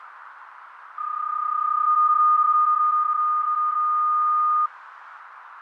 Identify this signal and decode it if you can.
PSK31 (31.25 baud), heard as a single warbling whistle, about 1220 Hz, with radio static, fading and a narrow filter.